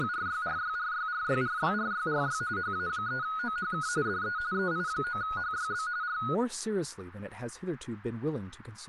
RTTY (45.45 baud, 170 Hz shift), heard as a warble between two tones, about 1360 Hz centre, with speech in English. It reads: … HA3OHK DE EI9HYB R